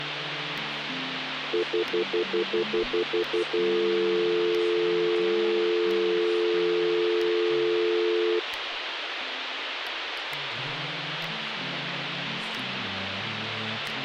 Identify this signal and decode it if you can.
Telephone call progress tone (North American plan), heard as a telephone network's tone, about 350, 440 Hz, 0.1 s on and 0.1 s off, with phone line noise. Stutter dial tone.